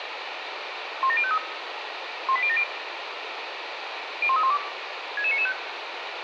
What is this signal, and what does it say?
Five-tone selective call (ZVEI), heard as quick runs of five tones, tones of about 70 ms, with radio hiss. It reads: 17053 18070 01312 66995